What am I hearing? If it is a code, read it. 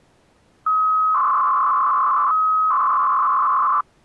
300-baud modem data (Bell 103 tones), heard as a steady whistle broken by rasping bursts, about 300 baud, 200 Hz shift.